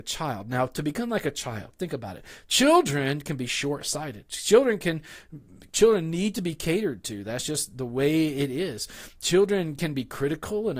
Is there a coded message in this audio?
No, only speech in English.